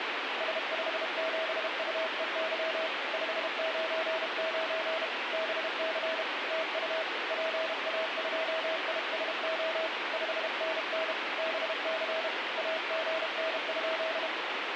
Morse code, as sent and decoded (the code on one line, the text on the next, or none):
... ..... --... ..- . -.-- / ..... ----. ----. / -... -.-. / - ..- / .--. .- ..--- .. ... --- / ..... -. -. / -... -.-. / .- --. -. ..--..
S57UEY 599 BC TU PA2ISO 5NN BC AGN?